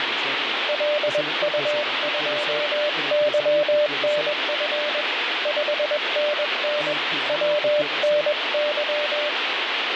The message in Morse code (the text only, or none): LU2YNF 5NN WNY